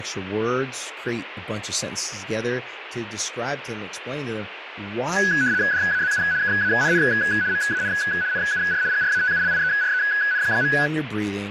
RTTY (75 baud, 170 Hz shift), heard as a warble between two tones, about 1600 Hz centre, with radio static and speech in English. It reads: DAZU KANN MAN NUR GRATULIEREN.